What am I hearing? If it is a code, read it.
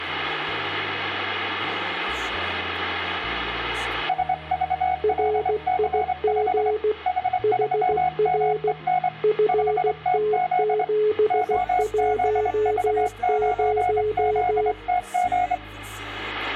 Morse code, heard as two keyed tones. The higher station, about 25 wpm, 730 Hz: SVLC5 H3MEN 5TZ OZV9ZTG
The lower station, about 16 wpm, 430 Hz: RIG HR FT710